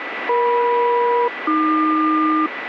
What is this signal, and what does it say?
Aircraft SELCAL, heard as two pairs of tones, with radio static and a steady whistle near 1970 Hz. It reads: EM-AQ